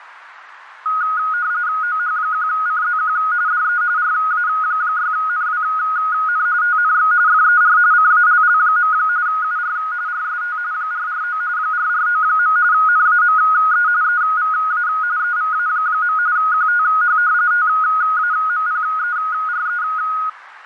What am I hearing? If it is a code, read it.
RTTY (45.45 baud, 170 Hz shift), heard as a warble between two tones, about 1350 Hz centre, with radio static and fading. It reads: OH1CZQ DE RA6NWN TNX FER CALL. UR RST 449 449. NAME EVA EVA. QTH TAMPERE